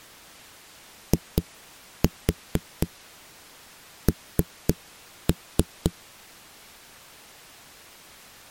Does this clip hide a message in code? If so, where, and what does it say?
Yes: tap code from 1.1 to 5.9 s, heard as knocks on a wall, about 4 knocks a second. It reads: IN